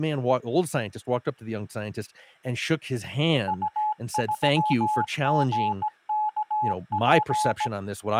Morse code, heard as a keyed tone, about 17 wpm, 850 Hz, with speech in English. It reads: U3GKP